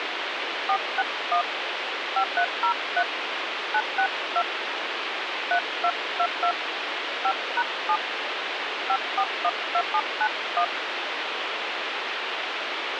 DTMF, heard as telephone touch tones, dialled by hand, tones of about 70 ms, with radio hiss. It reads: 461 5303 962 3222 5#7 5412791